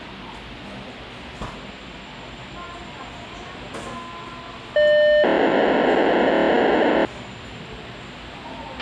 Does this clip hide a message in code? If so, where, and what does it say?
Yes: POCSAG pager data (1200 baud) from 4.8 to 7.1 s, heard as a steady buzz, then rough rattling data, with a squelch burst at the end and the noise of a cafe.